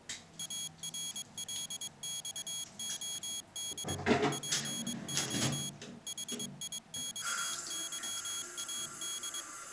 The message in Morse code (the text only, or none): ARLXOD PO HIXYAD